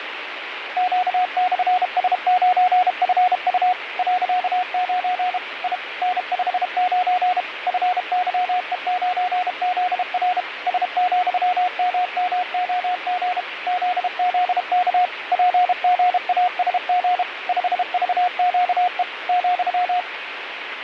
Morse code, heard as a keyed tone, machine-sent, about 32 wpm, 720 Hz, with radio static. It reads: Q/S9FU .9 I N59 FYE9ZR S,MMOG ZZK PGASG 5VQE ,